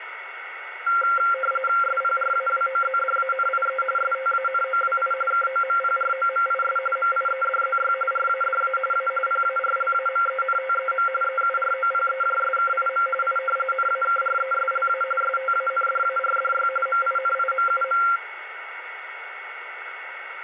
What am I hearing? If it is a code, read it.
RTTY (45.45 baud, 850 Hz shift), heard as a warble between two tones, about 950 Hz centre, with radio static and a steady whistle near 2200 Hz. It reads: SPRAWOZDANIE STANOWI KOMPROMIS MIEDZY RADA A PARLAMENTEM EUROPEJSKIM I NAKRESLA STANDARDY MINIMUM